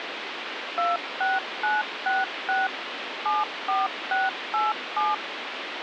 DTMF, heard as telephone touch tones, dialled by machine, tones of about 180 ms, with phone line noise. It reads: 26966 74687